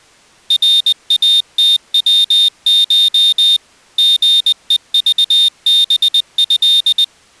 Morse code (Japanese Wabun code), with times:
0.5-3.6 ナイムヤコ
4.0-7.0 リヘクハト

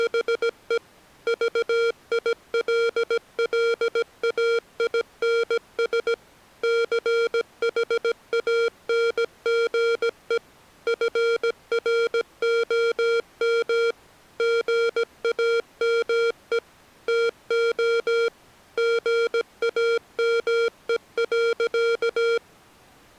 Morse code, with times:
0.0-0.8 …
1.3-6.1 VILLAINS
6.6-10.4 CHANGE
10.9-13.9 FROM
14.4-16.6 GAME
17.1-18.3 TO
18.8-22.4 GAME.

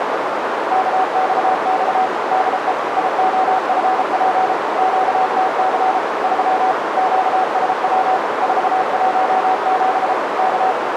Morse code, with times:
0.7-2.1 KXX
2.3-2.7 DE
3.0-4.5 IOFP
4.8-6.0 QTC
6.2-6.7 3
7.0-8.2 QSW
8.4-10.1 417
10.4-10.7 K

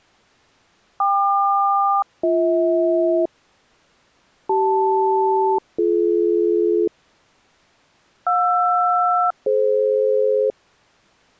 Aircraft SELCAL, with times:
1.0-3.3 KQ-BH
4.5-6.9 CL-BD
8.3-10.5 JR-DF

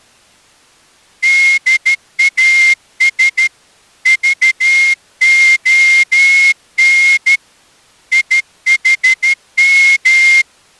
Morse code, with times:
1.2-3.5 DAS
4.1-7.4 VON
8.1-10.4 IHM

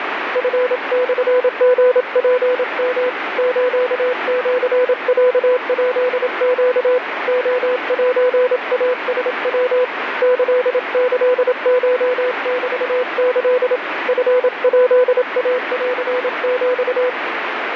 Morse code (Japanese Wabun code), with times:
0.4-3.1 チモリツヨ
3.4-7.0 スシロヱネ
7.3-9.8 レセイラヤ
10.2-13.8 キキコメキ
14.1-17.1 チヱインヒ

